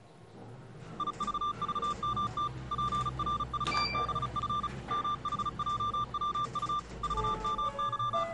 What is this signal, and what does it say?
Morse code, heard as a keyed tone, machine-sent, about 35 wpm, 1190 Hz, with the noise inside a lift. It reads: IVVMT PRVBF MHJWU …